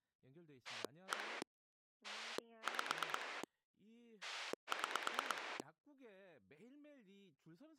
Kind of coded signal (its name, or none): pulse dialling